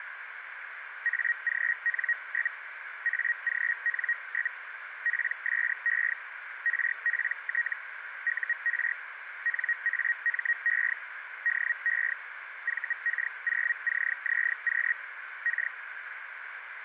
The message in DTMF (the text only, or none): none